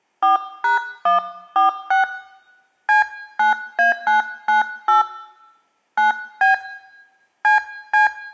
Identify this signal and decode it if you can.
DTMF, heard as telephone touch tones, dialled by hand, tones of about 140 ms. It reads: 4#146 C9A998 9B CC